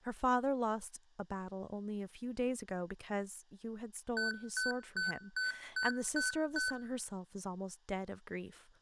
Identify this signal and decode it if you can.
Beep code, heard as beeps from a small speaker, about 1500 Hz, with room echo and speech in English. 7 short. In AMI BIOS tables: virtual mode exception error; in Dell tables: processor failure.